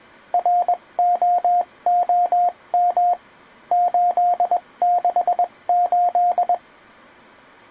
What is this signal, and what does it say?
Morse code, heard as a keyed tone, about 21 wpm, spaced as for 18 wpm, 710 Hz. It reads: ROOM 868